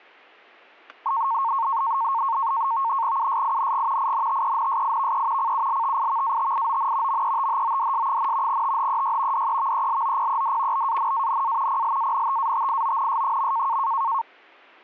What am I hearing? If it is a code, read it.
NAVTEX (SITOR-B), 100 baud, 170 Hz shift, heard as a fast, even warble, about 1000 Hz centre, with static crashes. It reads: USING INTENSIVE CULTIVATION METHODS, THEY DEVELOPED BANANA PLANTATIONS.